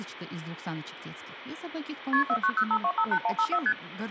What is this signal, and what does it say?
Multi-frequency trunk signalling (R1, as on North American trunks), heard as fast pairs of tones, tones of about 70 ms, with phone line noise, hum and speech in Russian. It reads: KP 4905258154 ST